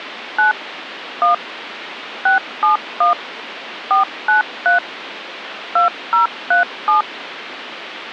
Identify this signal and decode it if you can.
DTMF, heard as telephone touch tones, dialled by machine, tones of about 130 ms, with phone line noise. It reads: 9 1 671 493 2037